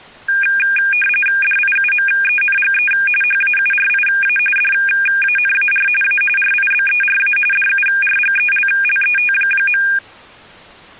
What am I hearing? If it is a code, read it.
RTTY (45.45 baud, 850 Hz shift), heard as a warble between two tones, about 2000 Hz centre. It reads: DIUMENGE HAURIA DANAR A RIBERA DURGELLET.